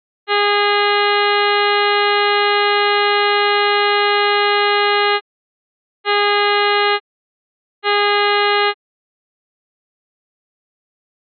Ship horn signal, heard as a ship's horn, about 410 Hz. 1 long, 2 short. At sea: a vessel in fog that is sailing, fishing, towing or hampered.